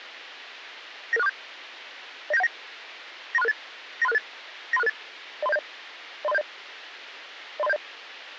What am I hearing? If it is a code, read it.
Five-tone selective call (EIA), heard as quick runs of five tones, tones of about 30 ms, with radio hiss. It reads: 99647 09719 93668 93668 93668 03070 03070 03070